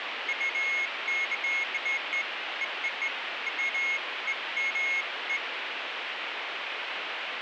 Beeps of irregular length, with radio static. There is no code.